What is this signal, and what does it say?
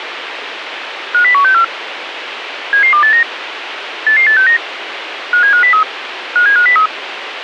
Five-tone selective call (CCIR), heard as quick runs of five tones, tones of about 100 ms, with radio hiss. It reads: 50164 77289 88869 57503 57503